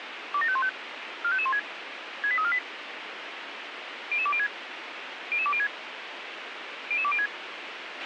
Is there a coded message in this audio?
Yes: five-tone selective call (ZVEI) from 0.3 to 7.3 s, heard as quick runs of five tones, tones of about 70 ms, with radio hiss and a squelch burst at the end. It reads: 27515 45516 68348 00206 00206 00206